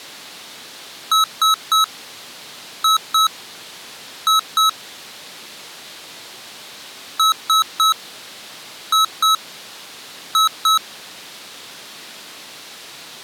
Beep code, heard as beeps from a small speaker, played twice, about 1290 Hz. 3-2-2.